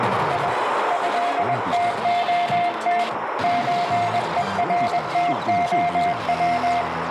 Morse code (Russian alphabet), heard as a keyed tone, hand-sent with a paddle, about 21 wpm, 700 Hz, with heavy radio static and a narrow filter. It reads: И ЭТОТ ЧЕРТОВ